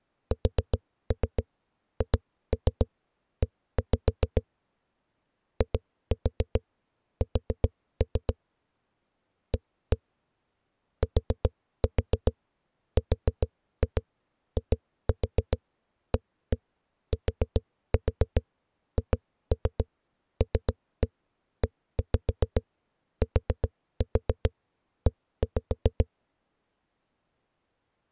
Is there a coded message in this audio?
Yes: tap code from 0.3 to 26.1 s, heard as knocks on a wall, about 7 knocks a second. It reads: SHE IS A TRIATHLETE